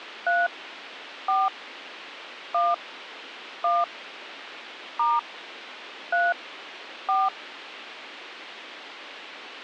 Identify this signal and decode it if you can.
DTMF, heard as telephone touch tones, dialled by hand, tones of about 200 ms, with radio hiss. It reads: 3 4 1 1 * 3 4